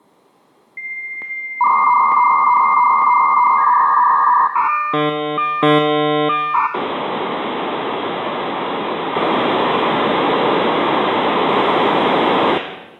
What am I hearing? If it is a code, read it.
Dial-up modem handshake (V.34 or later), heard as a whistle, warbles, then hiss, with room echo.